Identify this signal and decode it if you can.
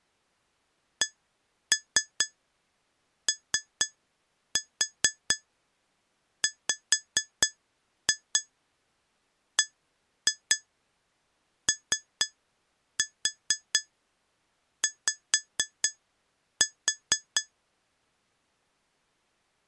Tap code, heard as taps on glass, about 4 knocks a second. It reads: COWBOY